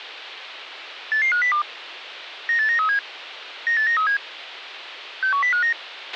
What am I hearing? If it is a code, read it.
Five-tone selective call (CCIR), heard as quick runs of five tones, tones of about 100 ms, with radio hiss and a squelch burst at the end. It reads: 88502 98937 98937 61059